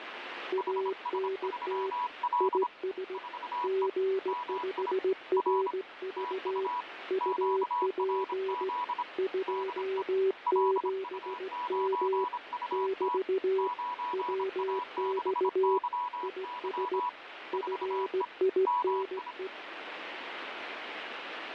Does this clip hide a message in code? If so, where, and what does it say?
Yes: Morse code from 0.5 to 19.5 s, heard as two keyed tones, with radio static. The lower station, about 17 wpm, 380 Hz: ANT IS G5RV UP 27M <BT> WX IS FINE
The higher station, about 26 wpm, 980 Hz: HS3L 4E MI R TU QRZ DE LU9UT 9A6YY 4E MI